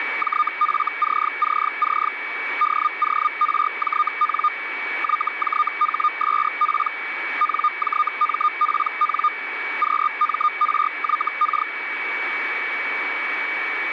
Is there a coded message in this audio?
Yes: Hellschreiber (Feld-Hell, 122.5 baud) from 0.2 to 11.7 s, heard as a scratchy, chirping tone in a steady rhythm, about 1220 Hz, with radio static and a steady whistle near 2270 Hz. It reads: JFCCC DORJN YJHSP NJMPN QMRYK